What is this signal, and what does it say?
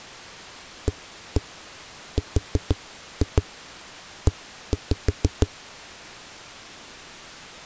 Tap code, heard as knocks on a wall, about 6 knocks a second. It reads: ARE